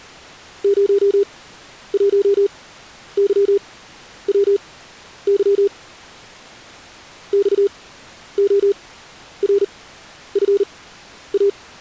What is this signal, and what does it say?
Morse code, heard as a keyed tone, machine-sent, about 39 wpm, spaced as for 11 wpm, 400 Hz. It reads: 01YWY XORFA